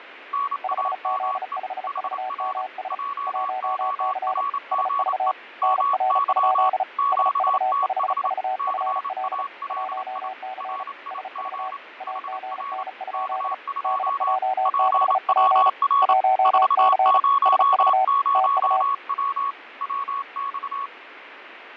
Morse code, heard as two keyed tones, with radio static and fading. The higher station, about 28 wpm, 1120 Hz: NAME HR JORGE MY QTH CALI RIG HR K2 PWR 400W WX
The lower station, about 35 wpm, 760 Hz: 5Z5VMS 1C SV NR? SV5VFL 1C SV AGN? DJ6P 1C SV TU